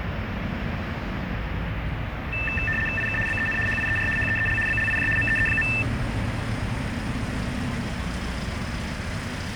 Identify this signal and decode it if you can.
RTTY (75 baud, 850 Hz shift), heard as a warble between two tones, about 2200 Hz centre, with radio static and the noise of a residential street. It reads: IK BEN HIER HEEL BLIJ MEE.